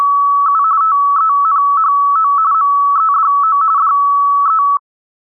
RTTY (45.45 baud, 170 Hz shift), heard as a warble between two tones, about 1220 Hz centre. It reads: … TENHO MEDO DE